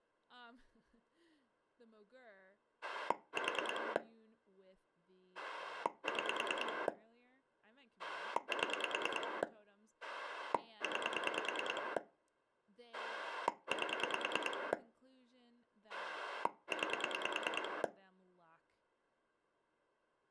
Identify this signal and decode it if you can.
Pulse dialling, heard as a rotary dial, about 9 pulses a second, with speech in English. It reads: 4 6 7 9 8 9